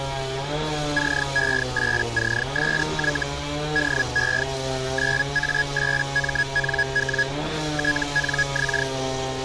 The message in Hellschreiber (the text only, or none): CE8CSY DE 9A8MNW TNX